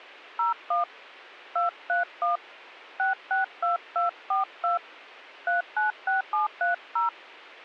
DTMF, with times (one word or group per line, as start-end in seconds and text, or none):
0.4-0.8 01
1.6-2.4 231
3.0-4.8 662242
5.5-7.1 396730